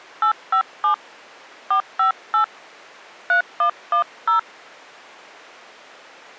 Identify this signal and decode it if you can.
DTMF, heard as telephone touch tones, dialled by hand, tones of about 100 ms. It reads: 857 458 3110